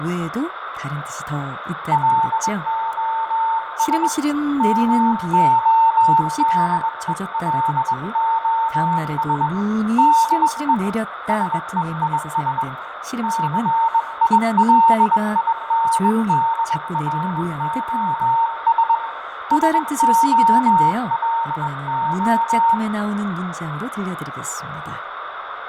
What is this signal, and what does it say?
Morse code, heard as a keyed tone, hand-sent with a bug key, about 21 wpm, 910 Hz, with radio static, fading, room echo and speech in Korean. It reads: LOS MODELOS DE SEIS CILINDROS SOLO